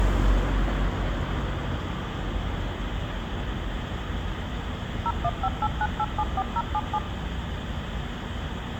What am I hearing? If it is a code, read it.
DTMF, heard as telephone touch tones, dialled by machine, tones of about 50 ms, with phone line noise and street noise. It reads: 01589874077